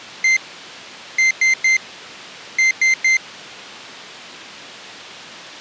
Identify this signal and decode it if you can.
Beep code, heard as a piezo beeper, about 2100 Hz. 1-3-3. In Phoenix BIOS tables: chip or data line failure in the first 64 KB of memory.